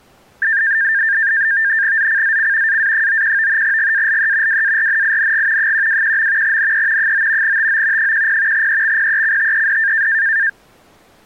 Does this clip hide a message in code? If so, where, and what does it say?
Yes: NAVTEX (SITOR-B), 100 baud, 170 Hz shift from 0.4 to 10.5 s, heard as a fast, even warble, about 1700 Hz centre. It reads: ZCZC AA91 GALE WARNING 121. NE 9 TO 10 EXPECTED